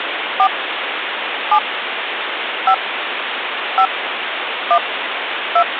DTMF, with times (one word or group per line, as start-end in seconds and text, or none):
0.4-0.5 4
1.5-1.6 7
2.7-2.7 5
3.8-3.9 5
4.7-4.8 1
5.6-5.6 2